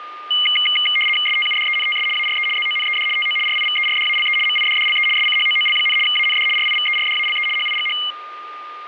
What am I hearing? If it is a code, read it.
RTTY (75 baud, 850 Hz shift), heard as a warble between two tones, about 2550 Hz centre, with a steady whistle near 1210 Hz. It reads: STUDENTS ARE ZONED TO RIVERDALE MIDDLE SCHOOL, AND RIVERDALE HIGH